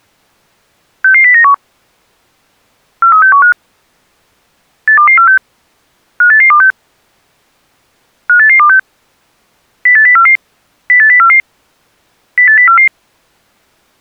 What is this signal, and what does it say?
Five-tone selective call (CCIR), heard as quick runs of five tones, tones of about 100 ms. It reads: 66091 43615 82246 58826 58826 08044 08044 08044